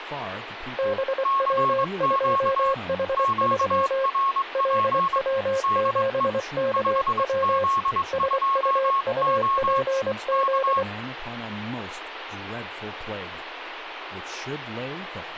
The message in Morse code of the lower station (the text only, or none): BW2H3 LW7KW SUUPZ